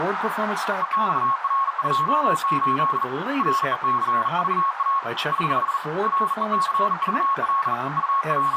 Morse code, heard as a keyed tone, hand-sent with a bug key, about 40 wpm, 1100 Hz, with radio static, a narrow filter and speech in English. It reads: EXR28 RECVA <HH> RECVL …